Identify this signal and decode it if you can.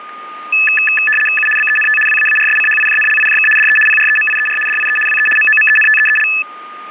RTTY (75 baud, 850 Hz shift), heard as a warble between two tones, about 2150 Hz centre, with static crashes and a steady whistle near 1220 Hz. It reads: U BENT WAARSCHIJNLIJK DE PREMIER DIE WE MOMENTEEL